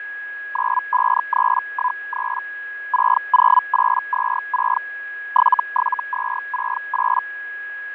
Hellschreiber (Feld-Hell, 122.5 baud), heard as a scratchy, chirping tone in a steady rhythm, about 1000 Hz, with fading and a steady whistle near 1660 Hz. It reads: 95313 60826 77268